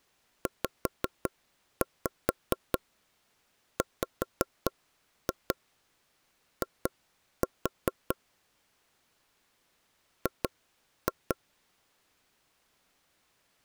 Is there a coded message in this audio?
Yes: tap code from 0.5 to 11.4 s, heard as knocks on wood, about 4 knocks a second. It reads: ZWI G